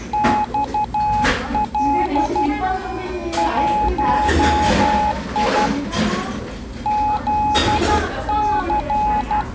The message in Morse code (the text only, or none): XL 1I ZC